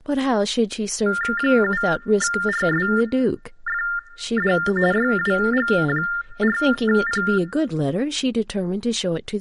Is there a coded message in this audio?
Yes: TTY/TDD text telephone tones (45.45 baud Baudot) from 1.1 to 7.4 s, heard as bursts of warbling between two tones, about 400 Hz shift, 1600 Hz centre, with speech in English. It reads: 7RSFD YWG4P